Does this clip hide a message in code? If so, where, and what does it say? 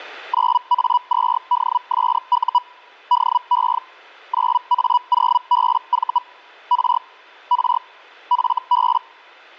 Yes: Hellschreiber (Feld-Hell, 122.5 baud) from 0.3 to 9.0 s, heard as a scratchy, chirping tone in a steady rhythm, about 980 Hz. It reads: 9A2DSU DE 9A0BV R R FB